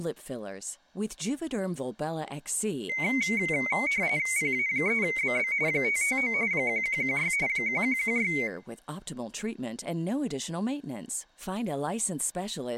RTTY (45.45 baud, 170 Hz shift), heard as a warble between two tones, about 2150 Hz centre, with speech in English. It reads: PA3BB 559 1116 1116